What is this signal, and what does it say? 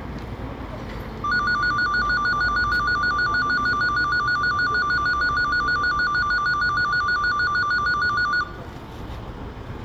A tone that alternates evenly between two pitches, with room echo and the noise of a residential street. There is no code.